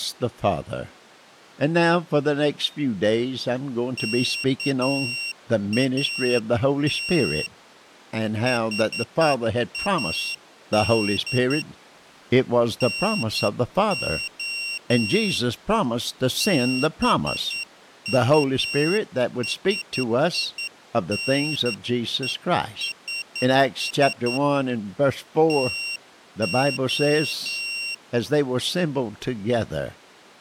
Morse code, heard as a high beeper, hand-sent with a straight key, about 10 wpm, 2750 Hz. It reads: KAT HAD NO BUSINESS TO